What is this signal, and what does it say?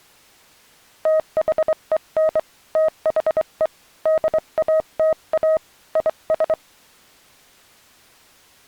Morse code, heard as a keyed tone, hand-sent with a straight key, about 24 wpm, 630 Hz. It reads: THEN THE DATA IS